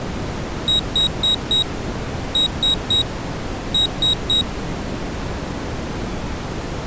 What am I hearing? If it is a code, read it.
Beep code, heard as a piezo beeper, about 3800 Hz. 4-3-3. In Phoenix BIOS tables: timer channel 2 failure.